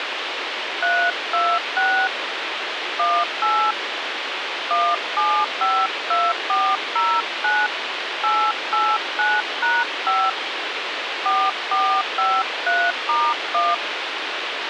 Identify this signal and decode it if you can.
DTMF, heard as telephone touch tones, dialled by hand, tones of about 260 ms, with radio hiss. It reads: 326 18 1752409 889#5 4453*1